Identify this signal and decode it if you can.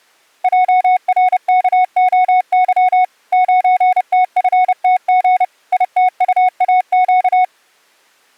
Morse code, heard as a keyed tone, machine-sent, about 30 wpm, 740 Hz. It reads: JRKOY 9TFTG ITUAQ